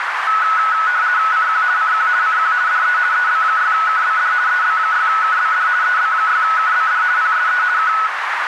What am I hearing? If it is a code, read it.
RTTY (50 baud, 170 Hz shift), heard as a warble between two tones, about 1380 Hz centre, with radio static and a narrow filter. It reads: CQ CQ CQ DE EB6KBD EB6KBD EB6KBD PSE K